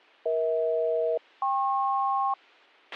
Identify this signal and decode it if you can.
Aircraft SELCAL, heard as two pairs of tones, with a squelch burst at the end. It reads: EH-KP